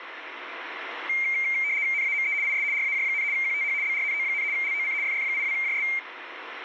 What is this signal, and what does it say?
RTTY (75 baud, 170 Hz shift), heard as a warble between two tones, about 2200 Hz centre, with radio static. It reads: NAME IS RAJ, QTH BRNO, LOC FF82JS